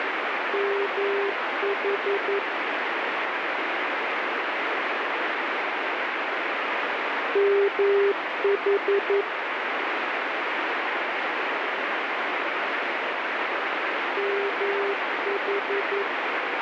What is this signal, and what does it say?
Morse code, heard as a keyed tone, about 11 wpm, 400 Hz, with heavy radio static. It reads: MH MH MH